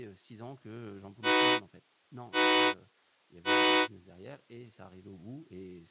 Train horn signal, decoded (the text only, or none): 3 short